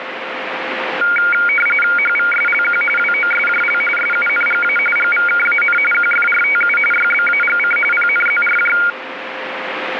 RTTY (45.45 baud, 850 Hz shift), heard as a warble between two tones, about 1850 Hz centre, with radio static. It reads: HVSLQ WOSJL SUNGA GVKAN QFRTU YBAGC PNZRJ